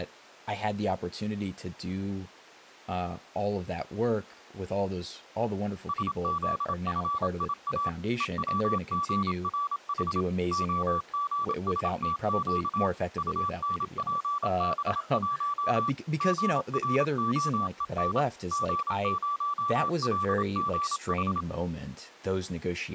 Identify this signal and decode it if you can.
Morse code, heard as a keyed tone, machine-sent, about 27 wpm, 1160 Hz, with speech in English. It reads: SZFIA EWGRH OGSTQ UNPB1 GROEN G0LGH